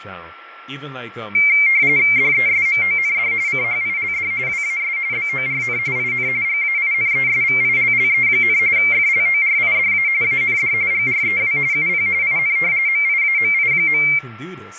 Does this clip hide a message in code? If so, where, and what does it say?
Yes: RTTY (45.45 baud, 170 Hz shift) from 1.3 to 14.2 s, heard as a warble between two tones, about 2200 Hz centre, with radio static, a steady whistle near 1350 Hz and speech in English. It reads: DESMOND CHILD WAS BORN IN GAINESVILLE, FLORIDA AND GREW UP IN MIAMI.